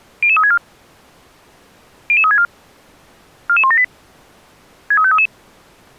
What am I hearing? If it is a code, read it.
Five-tone selective call (ZVEI), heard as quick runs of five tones, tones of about 70 ms. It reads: 00364 00364 44178 63533